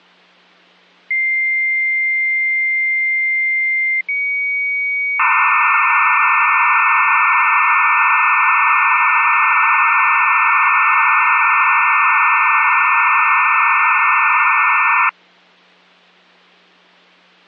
Dial-up modem handshake (low-speed, two carriers), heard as two whistles, then hiss.